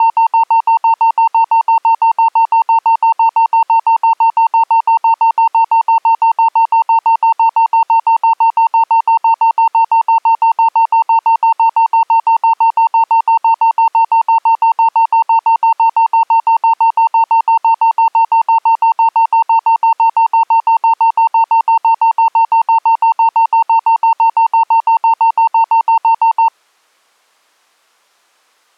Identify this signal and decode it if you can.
Evenly repeated beeps. There is no code.